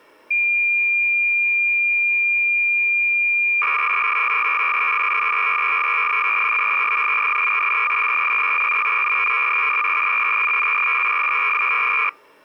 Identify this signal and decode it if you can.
Cassette data (Kansas City type), 300 baud, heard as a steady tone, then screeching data.